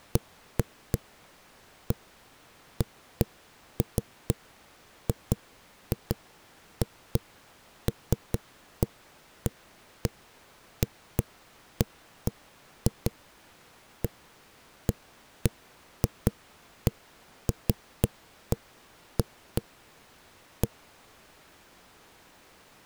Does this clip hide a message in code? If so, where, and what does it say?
No, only irregular knocks on a wall.